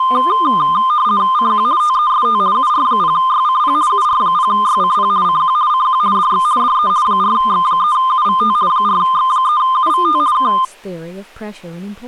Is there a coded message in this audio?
Yes: RTTY (50 baud, 170 Hz shift) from 0.0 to 10.7 s, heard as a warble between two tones, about 1130 Hz centre, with speech in English. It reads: CQ TEST UR0YCP UR0YCP CQ CQ DX DE 4X3UVT 4X3UVT K